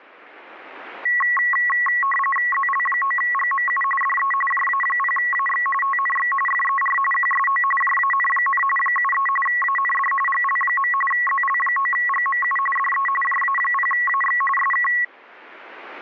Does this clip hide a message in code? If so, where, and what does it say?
Yes: RTTY (45.45 baud, 850 Hz shift) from 1.1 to 15.0 s, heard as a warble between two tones, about 1500 Hz centre. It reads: ZL9GMU DE JA0AX TNX FER QSO JAN, 73 AND GL. ZL9GMU DE JA0AX SK